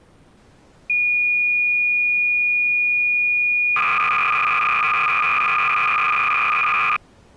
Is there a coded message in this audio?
Yes: cassette data (Kansas City type), 300 baud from 0.9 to 7.0 s, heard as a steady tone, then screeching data.